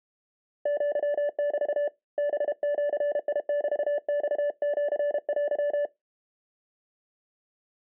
Morse code (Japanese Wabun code), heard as a keyed tone, hand-sent with a paddle, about 32 wpm, 580 Hz. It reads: アメ ハジメマシテ